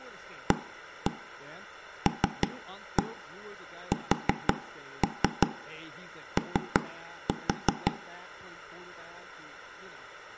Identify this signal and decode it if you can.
Tap code, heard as knocks on wood, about 5 knocks a second, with room echo and speech in English. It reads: ALSO